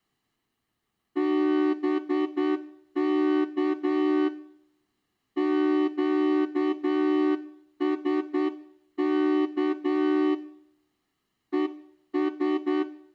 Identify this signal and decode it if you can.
Morse code, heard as a horn, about 9 wpm. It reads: BK QSK ES